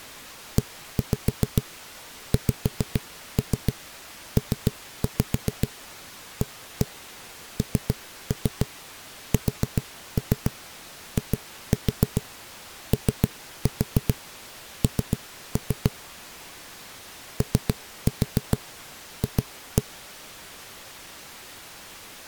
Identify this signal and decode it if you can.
Tap code, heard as knocks on a wall, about 7 knocks a second. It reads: EXPANSION OF